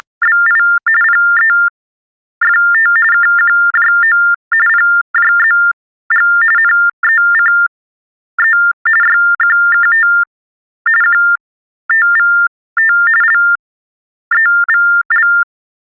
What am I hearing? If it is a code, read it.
TTY/TDD text telephone tones (45.45 baud Baudot), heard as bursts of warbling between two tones, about 400 Hz shift, 1600 Hz centre. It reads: … PEFT KQJO PJZG NECE YQKT QTVT LEVL